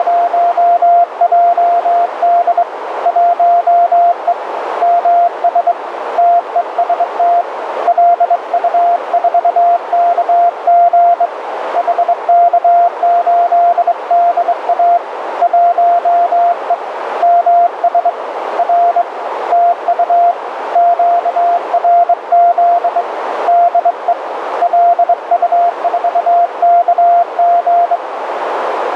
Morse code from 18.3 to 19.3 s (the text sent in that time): R